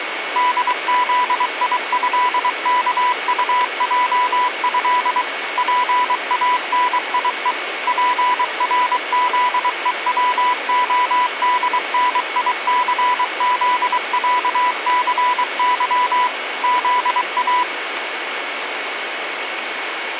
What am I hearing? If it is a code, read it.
Morse code (with Polish letters), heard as a keyed tone, machine-sent, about 23 wpm, 990 Hz, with radio static and a steady whistle near 2220 Hz. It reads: DZIĘKUJĘ PANIE PRZEWODNICZĄCY ZA